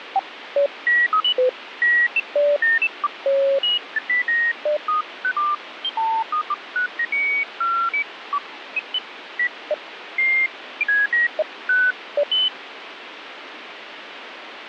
Electronic bleeps of random pitch and length, with radio static. There is no code.